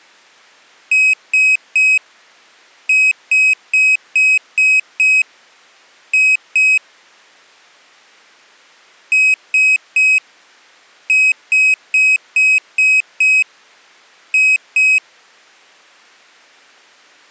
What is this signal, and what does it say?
Beep code, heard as a piezo beeper, played twice, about 2550 Hz. 3-6-2.